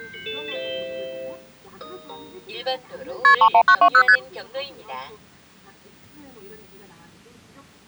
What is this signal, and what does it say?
Multi-frequency trunk signalling (R1, as on North American trunks), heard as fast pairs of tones, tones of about 70 ms, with the noise inside a car. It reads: KP 31920 ST